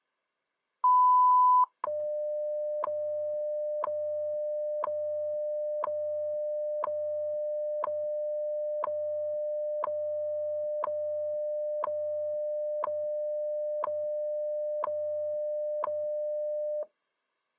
Radio time signal (WWV, Colorado), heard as ticks, one a second.